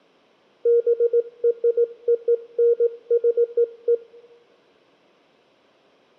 Morse code (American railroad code), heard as a keyed tone, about 470 Hz, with room echo. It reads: BRONZE